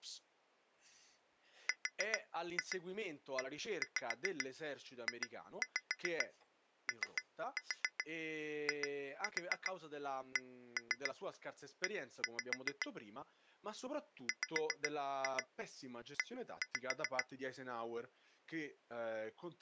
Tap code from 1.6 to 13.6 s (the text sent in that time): REJOICE